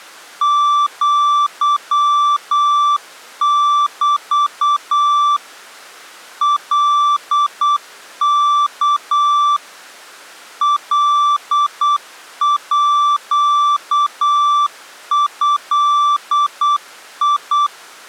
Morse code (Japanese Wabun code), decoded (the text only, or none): アメ カワ カード